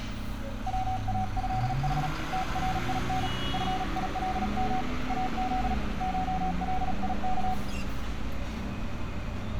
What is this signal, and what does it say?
Morse code (Persian alphabet), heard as a keyed tone, hand-sent with a paddle, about 37 wpm, 750 Hz, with room echo and street noise. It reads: واضح ترین فیلم از شلیک